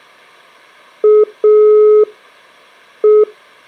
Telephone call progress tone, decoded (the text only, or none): dial tone